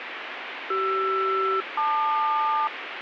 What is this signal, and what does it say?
Aircraft SELCAL, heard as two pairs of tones, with radio static. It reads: CR-LQ